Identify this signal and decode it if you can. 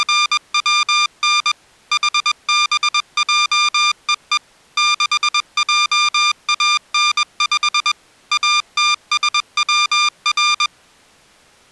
Morse code, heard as electronic beeps, machine-sent, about 21 wpm, 1200 Hz. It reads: … HBJEE 6JAN5 ATSWR